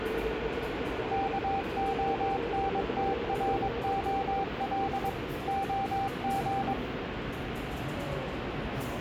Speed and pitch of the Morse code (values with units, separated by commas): 22 wpm, 780 Hz